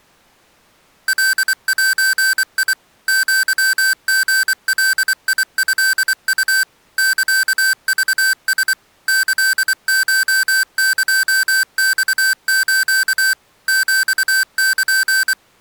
Morse code (Japanese Wabun code), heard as electronic beeps, machine-sent, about 24 wpm, 1550 Hz. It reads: カゼ アリガトウ サクラ キコエマス ヒル